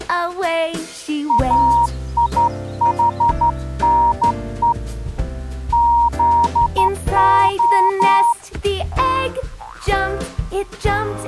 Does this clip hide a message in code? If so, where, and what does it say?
Yes: Morse code (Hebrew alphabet) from 1.2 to 8.4 s, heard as a keyed tone, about 12 wpm, 940 Hz. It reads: איחנו זה